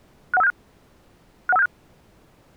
Five-tone selective call (EIA), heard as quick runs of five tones, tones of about 30 ms. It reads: 61576 61576